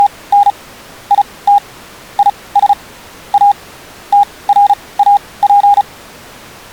Morse code, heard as a keyed tone, machine-sent, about 35 wpm, spaced as for 22 wpm, 810 Hz. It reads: … IT IS A TRAP